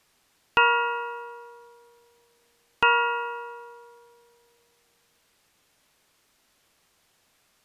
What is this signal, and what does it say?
Clock strike, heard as a bell. 2. Two o'clock.